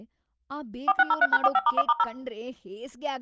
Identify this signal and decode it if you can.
DTMF, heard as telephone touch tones, dialled by machine, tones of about 40 ms, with speech in Kannada. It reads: 4603#45*1*0